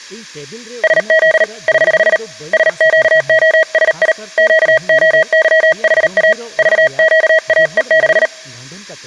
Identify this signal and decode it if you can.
Morse code, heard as a keyed tone, hand-sent with a paddle, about 38 wpm, 640 Hz, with speech in Santali. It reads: SZ <HH> SQOSI QOYHA VQAE6